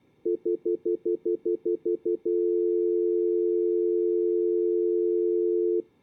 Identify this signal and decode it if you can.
Telephone call progress tone (North American plan), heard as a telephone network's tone, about 350, 440 Hz, 0.1 s on and 0.1 s off. Stutter dial tone.